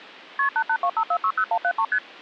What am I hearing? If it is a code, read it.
Multi-frequency trunk signalling (R1, as on North American trunks), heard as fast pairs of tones, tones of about 70 ms. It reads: KP 8825460173 ST